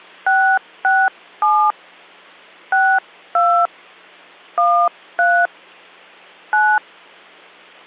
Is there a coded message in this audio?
Yes: DTMF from 0.3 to 6.8 s, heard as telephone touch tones, dialled by hand, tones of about 270 ms. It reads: 667 62 13 9